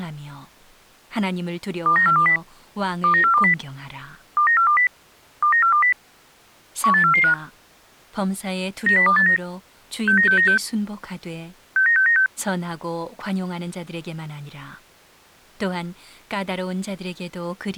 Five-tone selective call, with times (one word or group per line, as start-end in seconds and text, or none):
1.9-2.4 29420
3.0-3.5 29420
4.4-4.9 29420
5.4-5.9 29420
6.8-7.3 18445
8.9-9.4 90289
10.1-10.6 69696
11.8-12.3 69696